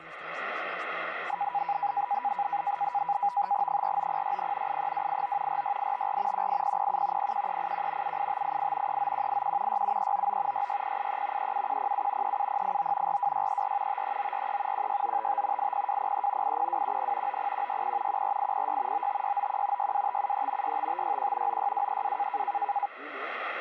NAVTEX (SITOR-B), 100 baud, 170 Hz shift, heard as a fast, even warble, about 900 Hz centre, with radio static and static crashes. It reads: 49060 83289 46854 18007 01381 78588 39181 67399 66083 37107 37089 42634 53943 16955 80203 80210 90160 14806 95691 62573 65561 96232